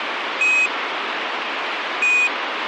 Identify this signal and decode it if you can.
Quindar tones, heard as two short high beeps, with radio hiss.